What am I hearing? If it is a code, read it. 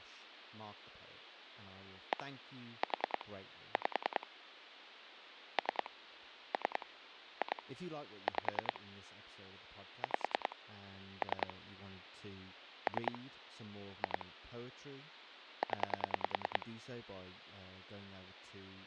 Pulse dialling, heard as clicks on a phone line, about 10 pulses a second, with speech in English. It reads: 1 4 5 3 3 2 5 5 3 3 2 0